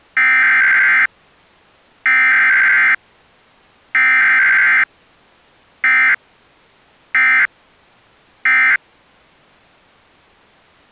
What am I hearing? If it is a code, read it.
Emergency Alert System (SAME) tones (header bursts, then end-of-message bursts), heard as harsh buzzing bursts, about 520.83 baud.